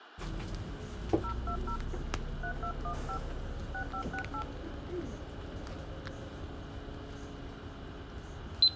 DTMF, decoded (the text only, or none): 020 3215 6568